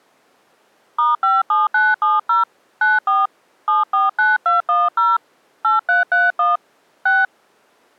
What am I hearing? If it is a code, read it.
DTMF, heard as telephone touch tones, dialled by hand, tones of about 170 ms. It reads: *57970 94 749210 8331 6